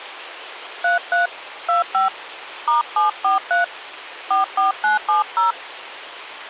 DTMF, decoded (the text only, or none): 33 25 *743 44970